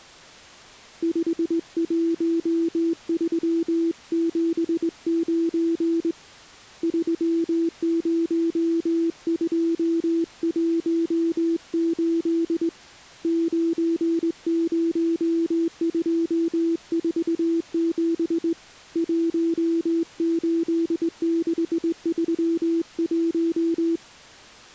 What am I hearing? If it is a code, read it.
Morse code, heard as a keyed tone, hand-sent with a straight key, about 20 wpm, 330 Hz. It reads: 51379 30218 90247 18631